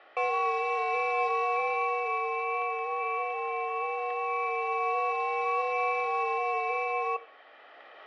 FT8 (several signals at once), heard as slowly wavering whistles, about 6.25 baud, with radio static, static crashes and room echo.